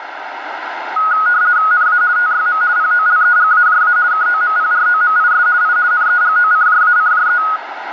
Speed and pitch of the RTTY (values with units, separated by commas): 50 baud, 170 Hz shift, 1360 Hz centre